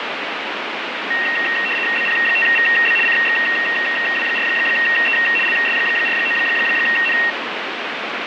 RTTY (75 baud, 850 Hz shift), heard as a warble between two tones, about 2300 Hz centre, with radio static. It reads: BP5VB CXW4E LS49N